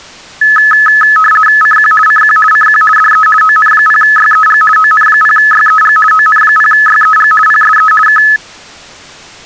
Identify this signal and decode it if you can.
RTTY (50 baud, 450 Hz shift), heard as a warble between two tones, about 1500 Hz centre. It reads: CQ CQ CQ DE ON0YEG ON0YEG ON0YEG PSE K